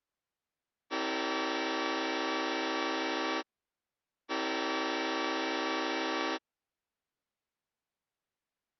Train horn signal, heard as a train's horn. 2 long. On North American railways: brakes released, proceed.